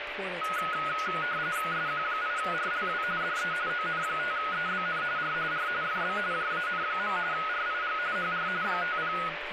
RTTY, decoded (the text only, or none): SQ8RLW DE ON5EBN R R FB JAN. RIG HR 50